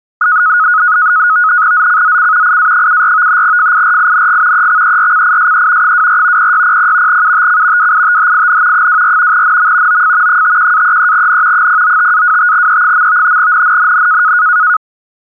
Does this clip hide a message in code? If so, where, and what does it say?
Yes: NAVTEX (SITOR-B), 100 baud, 170 Hz shift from 0.2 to 14.8 s, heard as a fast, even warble, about 1360 Hz centre. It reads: ZCZC IA74 FIRING EXERCISE 24 0600 UTC WITHIN 24 NM OF 51-33N 095-25E. NNNN